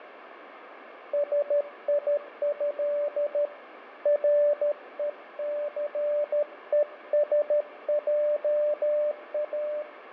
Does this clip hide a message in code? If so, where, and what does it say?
Yes: Morse code (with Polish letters) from 1.1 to 9.9 s, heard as a keyed tone, hand-sent with a paddle, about 13 wpm, 590 Hz, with radio static and fading. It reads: SIĘ RECESJA